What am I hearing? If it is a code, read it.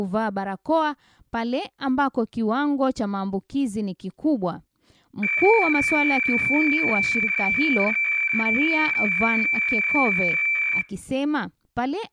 Weather fax (radiofax), 120 lines a minute, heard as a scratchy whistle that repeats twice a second, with speech in Swahili.